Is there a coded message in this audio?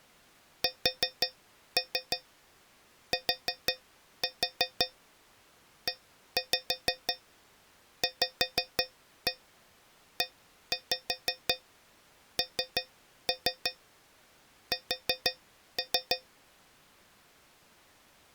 Yes: tap code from 0.6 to 16.3 s, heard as taps on a metal pipe, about 5 knocks a second. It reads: STEVENS